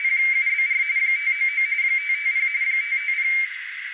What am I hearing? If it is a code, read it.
RTTY (45.45 baud, 170 Hz shift), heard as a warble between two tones, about 2200 Hz centre, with radio static and a narrow filter. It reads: … 599 550 550